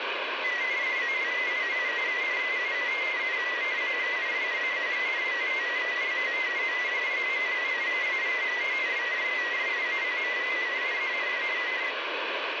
Multi-tone FSK (Olivia or MFSK type), about 250 Hz wide, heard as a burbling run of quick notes, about 31.25 baud, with radio static.